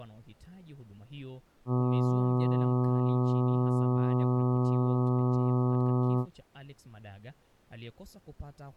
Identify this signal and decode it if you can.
Ship horn signal, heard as a ship's horn, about 120 Hz, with speech in Swahili. 1 long. At sea: a vessel nearing a blind bend, or under power and making way in fog.